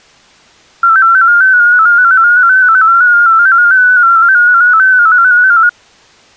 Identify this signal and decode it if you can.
Multi-tone FSK (Olivia or MFSK type), about 250 Hz wide, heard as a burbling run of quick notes, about 15.625 baud.